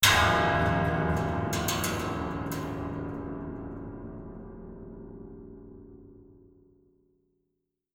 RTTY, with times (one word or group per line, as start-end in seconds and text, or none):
none